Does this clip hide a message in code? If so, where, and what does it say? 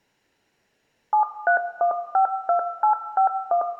Yes: DTMF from 1.1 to 3.6 s, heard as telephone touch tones, dialled by machine, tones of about 100 ms, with room echo. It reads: 73152851